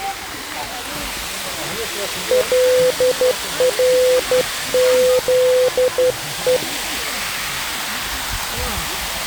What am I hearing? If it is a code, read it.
Morse code (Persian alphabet), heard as a keyed tone, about 12 wpm, 510 Hz, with the noise of a park. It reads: لرزه